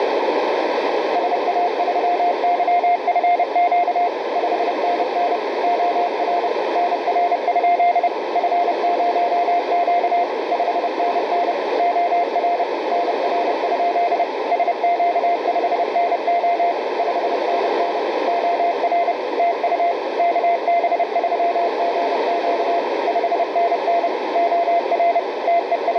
Morse code, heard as a keyed tone, machine-sent, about 30 wpm, 700 Hz, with heavy radio static and a narrow filter. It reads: SA3YFQ 5NN OR NR? F0Q 5NN OR NR? SQ5NO 5NN OR TU KB3GQ 5NN OR …